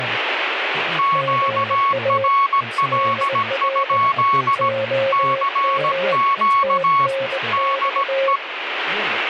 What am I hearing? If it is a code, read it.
Morse code, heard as two keyed tones, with radio static and speech in English. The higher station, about 17 wpm, 1110 Hz: QRL? CQ DE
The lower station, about 21 wpm, 540 Hz: GA DR OM TNX